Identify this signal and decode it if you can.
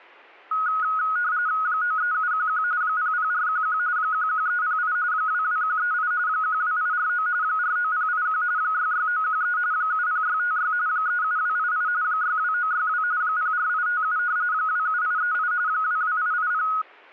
RTTY (45.45 baud, 170 Hz shift), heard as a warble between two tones, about 1360 Hz centre, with static crashes. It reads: 93711 00411 11308 22138 12849 49081 66913 70656 37288 62962 04857 27838 22880